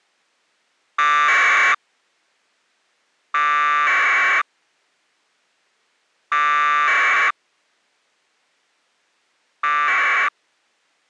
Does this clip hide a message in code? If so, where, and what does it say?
Yes: packet radio (AX.25, as in APRS), 1200 baud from 1.0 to 10.3 s, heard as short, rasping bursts.